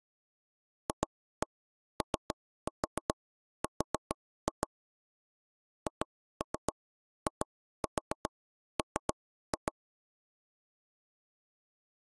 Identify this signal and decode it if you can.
Tap code, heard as taps on a table, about 7 knocks a second. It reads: FOR HIM